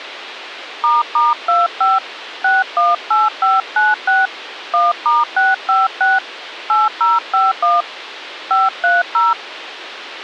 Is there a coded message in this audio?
Yes: DTMF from 0.8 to 9.3 s, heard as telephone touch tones, dialled by hand, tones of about 180 ms, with radio hiss. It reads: **25 618596 1*656 8051 530